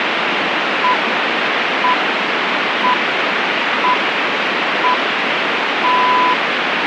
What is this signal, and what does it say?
Radio time signal (six pips, as the Greenwich Time Signal), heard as pips, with radio static.